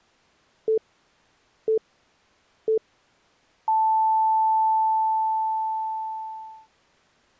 Radio time signal (three low pips and a long one an octave up, as on NHK), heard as pips.